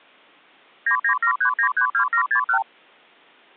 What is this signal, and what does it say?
Multi-frequency trunk signalling (R2, with the far end's replies), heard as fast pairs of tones, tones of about 90 ms. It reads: 9973932761